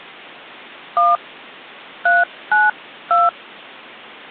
DTMF, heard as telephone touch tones, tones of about 180 ms. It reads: 1 392